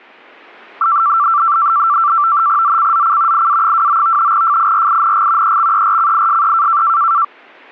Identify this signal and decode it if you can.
NAVTEX (SITOR-B), 100 baud, 170 Hz shift, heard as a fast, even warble, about 1250 Hz centre. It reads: ZCZC IA29 FIRING EXERCISE